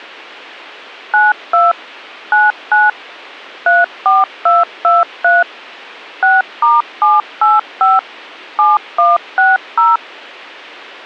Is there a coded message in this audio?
Yes: DTMF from 1.1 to 10.0 s, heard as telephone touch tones, dialled by machine, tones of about 180 ms. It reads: 92 99 34223 6*785 7160